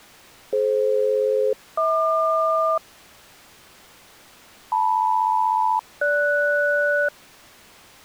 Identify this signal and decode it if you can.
Aircraft SELCAL, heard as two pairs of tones. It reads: DF-HQ LM-GS